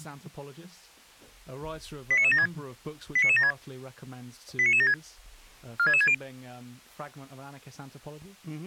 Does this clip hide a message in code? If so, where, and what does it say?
Yes: five-tone selective call (ZVEI) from 2.1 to 6.1 s, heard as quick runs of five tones, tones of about 70 ms. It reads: 89976 89976 89976 46660